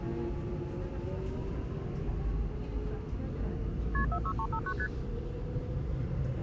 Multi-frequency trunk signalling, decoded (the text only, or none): KP 46359 ST